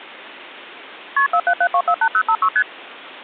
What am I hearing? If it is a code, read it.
Multi-frequency trunk signalling (R1, as on North American trunks), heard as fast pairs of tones, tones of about 70 ms. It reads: KP 477248056 ST